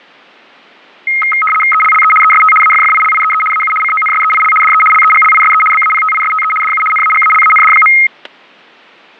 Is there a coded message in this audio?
Yes: RTTY (75 baud, 850 Hz shift) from 1.1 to 8.1 s, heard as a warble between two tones, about 1700 Hz centre, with static crashes. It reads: ELLE EST AFFILIEE AU CONSEIL DE LEGLISE BAPTISTE DU NAGALAND.